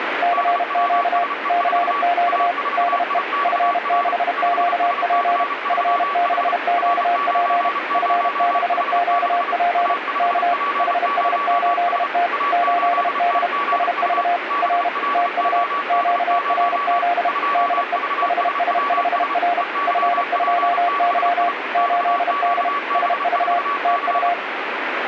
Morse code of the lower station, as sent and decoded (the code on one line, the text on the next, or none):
-.-. --.- / -.-. --.- / -.. . / ..-. -.... --.- .--. / ..-. -.... --.- .--. / ..-. -.... --.- .--. / -.- / .... ... ---.. - / ---.. -.. / ... ...- / .-. / - ..- / --.- .-. --.. / -.. . / .... ... ..... .-. / ..-. ..--- -.-- / ---.. -.. / ... ...- / - ..-
CQ CQ DE F6QP F6QP F6QP K HS8T 8D SV R TU QRZ DE HS5R F2Y 8D SV TU